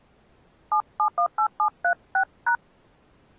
DTMF, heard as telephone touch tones, dialled by hand, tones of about 90 ms. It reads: 7718736#